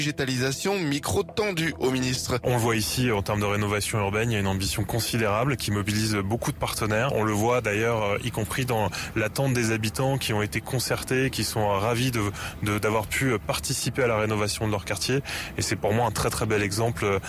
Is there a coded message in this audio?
No.